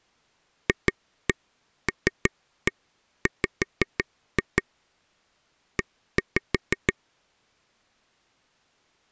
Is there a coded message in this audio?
Yes: tap code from 0.7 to 6.9 s, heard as taps on a table, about 6 knocks a second. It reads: FLW E